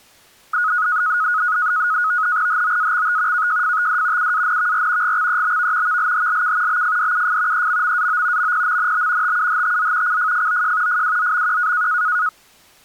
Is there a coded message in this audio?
Yes: NAVTEX (SITOR-B), 100 baud, 170 Hz shift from 0.5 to 12.3 s, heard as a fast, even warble, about 1360 Hz centre. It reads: HOAXT KJFTD UANVR GXEBV VLHLK BFDUF EMMAO MPMNB TUHTZ CFFOJ FWZMQ